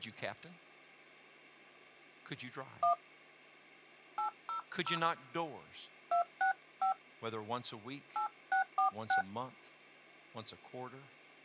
DTMF, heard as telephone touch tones, dialled by hand, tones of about 110 ms, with hum and speech in English. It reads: 1 800 265 8646